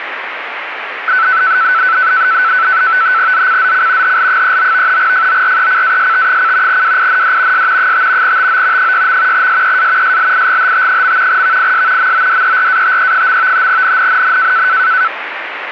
NAVTEX (SITOR-B), 100 baud, 170 Hz shift, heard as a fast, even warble, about 1420 Hz centre, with radio static. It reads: ZCZC HL39 FORECAST: WIND S 5 TO 6. SEA SLIGHT. VIS MODERATE. NNNN